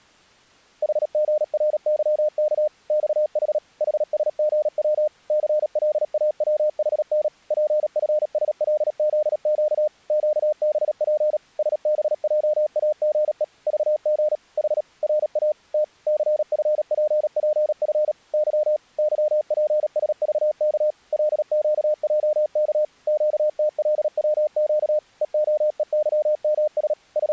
Morse code, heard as a keyed tone, machine-sent, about 37 wpm, 610 Hz. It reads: HGRYK XH HSGW CLAWHN PFSLZQ QBP SBJAGE VG H RA T CFPPF Y YPSVK LQJK QTLWQ EOEYMS …